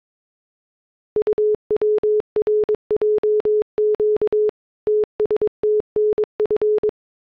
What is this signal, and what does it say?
Morse code, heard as a keyed tone, machine-sent, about 22 wpm, 420 Hz. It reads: UWRJQ TSTNF